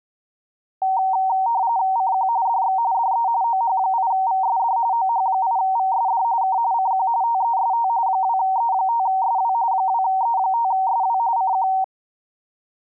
RTTY (45.45 baud, 170 Hz shift), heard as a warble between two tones, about 850 Hz centre. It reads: CQ DX DE OH8VSD OH8VSD K CQ TEST 2E5SW 2E5SW CQ